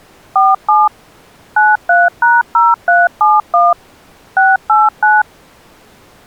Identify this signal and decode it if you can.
DTMF, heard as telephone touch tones, dialled by machine, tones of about 190 ms. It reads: 47 93#0371 689